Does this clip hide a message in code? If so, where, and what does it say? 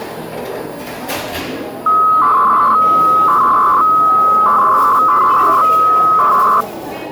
Yes: 300-baud modem data (Bell 103 tones) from 1.9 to 6.6 s, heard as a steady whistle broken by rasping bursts, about 300 baud, 200 Hz shift, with the noise of a cafe.